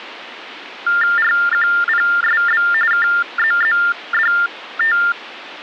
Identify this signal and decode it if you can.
TTY/TDD text telephone tones (45.45 baud Baudot), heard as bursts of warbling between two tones, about 400 Hz shift, 1600 Hz centre. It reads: RQPSB KZZDT